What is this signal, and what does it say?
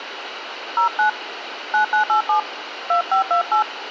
DTMF, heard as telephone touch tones, dialled by hand, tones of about 110 ms, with phone line noise. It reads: 09 9987 2528